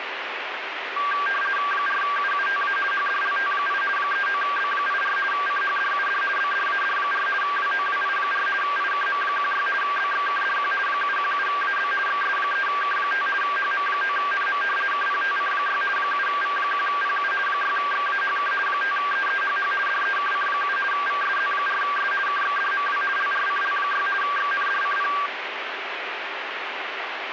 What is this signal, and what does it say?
RTTY (50 baud, 450 Hz shift), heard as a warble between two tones, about 1370 Hz centre, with radio static. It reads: 4UUTA HDLT8 39B84 CHDUD BDAD4 WOWI4 IKM16 BXKDQ 717AB XS3K5 HM9NM KPTC6 7V1PU 6XAHK 5EEHH DEKC7 VSZ4S KXDMW LRCL6 XNDCP